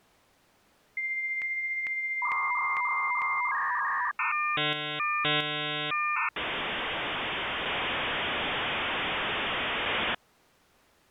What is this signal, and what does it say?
Dial-up modem handshake (V.34 or later), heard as a whistle, warbles, then hiss.